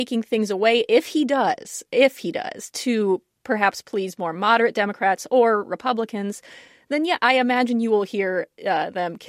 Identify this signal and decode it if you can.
Speech in English. There is no code.